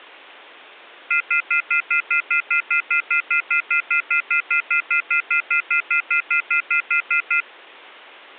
Telephone call progress tone (North American plan), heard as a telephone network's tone, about 1400, 2050, 2450, 2600 Hz, 0.1 s on and 0.1 s off. Off-hook warning tone.